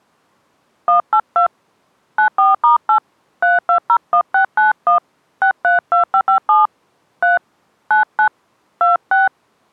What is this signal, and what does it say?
DTMF, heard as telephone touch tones, dialled by hand, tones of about 120 ms. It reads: 182 94*8 3201691 632557 3 99 26